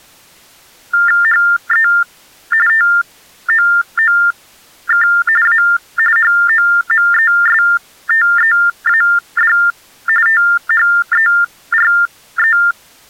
TTY/TDD text telephone tones (45.45 baud Baudot), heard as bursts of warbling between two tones, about 400 Hz shift, 1600 Hz centre. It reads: HE TOOK A HOMESTEAD THERE